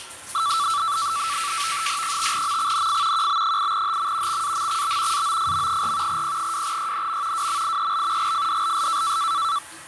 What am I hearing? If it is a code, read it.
NAVTEX (SITOR-B), 100 baud, 170 Hz shift, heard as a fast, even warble, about 1240 Hz centre, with the noise of a restroom. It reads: 5MXNF QB8HM XAMXB AOFM4 P2YNM WMIEL GFDLS